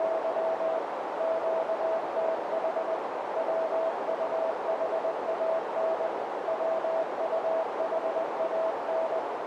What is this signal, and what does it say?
Morse code, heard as a keyed tone, machine-sent, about 20 wpm, 650 Hz, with heavy radio static and a narrow filter. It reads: … QTH WUHAN WUHAN